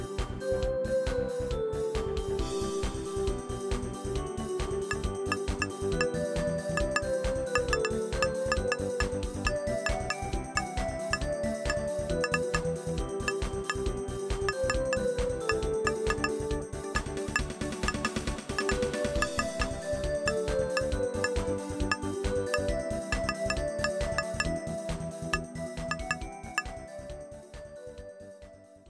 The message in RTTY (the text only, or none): none